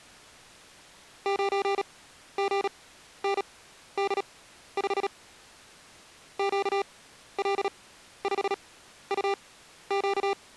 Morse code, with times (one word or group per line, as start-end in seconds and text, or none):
1.3-5.1 9GND5
6.4-10.3 QL5UQ